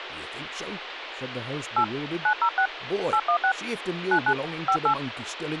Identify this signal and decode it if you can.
DTMF, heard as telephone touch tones, dialled by hand, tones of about 80 ms, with phone line noise and speech in English. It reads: 8 906 816 99 58